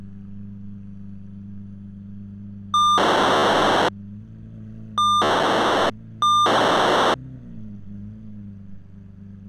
POCSAG pager data (2400 baud), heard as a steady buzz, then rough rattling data, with street noise.